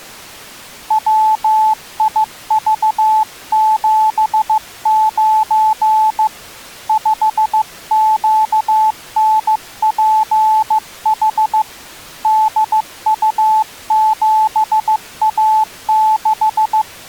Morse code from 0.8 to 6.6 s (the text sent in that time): WIV79